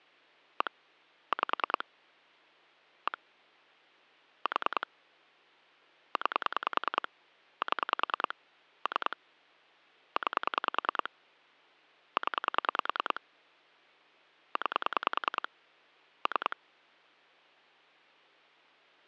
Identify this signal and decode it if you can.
Pulse dialling, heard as clicks on a phone line, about 10 pulses a second. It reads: 1 5 1 4 9 7 3 9 0 9 3